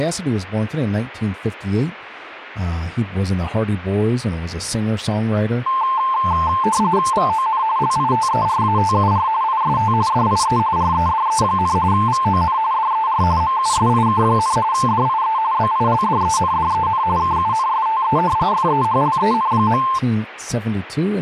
RTTY (45.45 baud, 170 Hz shift), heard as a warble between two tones, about 970 Hz centre, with speech in English. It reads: VON LITERATUR IST DIE REDE, VON DER MUSIK, DIE BILDENDEN KUNSTE FEHLEN.